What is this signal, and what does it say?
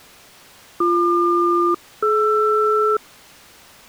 Aircraft SELCAL, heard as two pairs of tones. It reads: BQ-DR